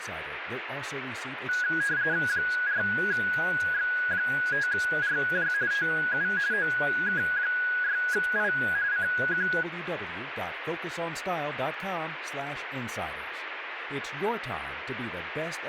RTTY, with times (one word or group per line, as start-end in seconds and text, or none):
2.3-5.5 4X5RJ
5.7-6.3 TU
6.5-8.5 OK6I
8.9-9.5 CQ